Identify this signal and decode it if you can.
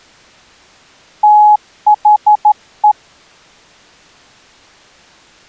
Morse code, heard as a keyed tone, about 12 wpm, 840 Hz. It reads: THE